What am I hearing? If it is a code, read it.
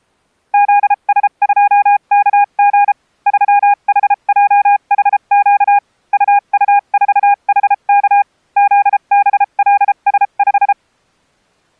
Morse code, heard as a keyed tone, machine-sent, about 33 wpm, spaced as for 29 wpm, 810 Hz. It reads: ZS2KG 3HJHQ UU4HK ZBLS5